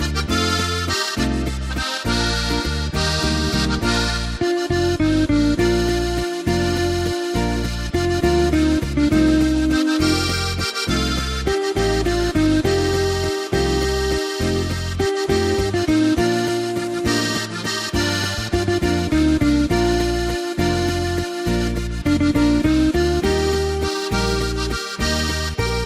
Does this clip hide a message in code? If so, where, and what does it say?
No.